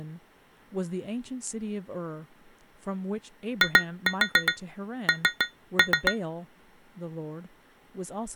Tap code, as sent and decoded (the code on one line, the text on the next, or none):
2-4 3-3
IN